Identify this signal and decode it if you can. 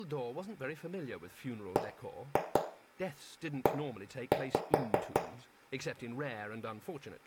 Tap code, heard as knocks on wood, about 5 knocks a second, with room echo and speech in English. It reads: BE